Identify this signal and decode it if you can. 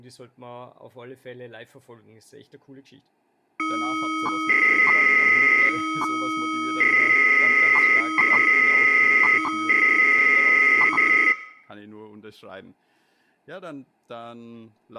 300-baud modem data (Bell 103 tones), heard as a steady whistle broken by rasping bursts, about 300 baud, 200 Hz shift, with speech in German.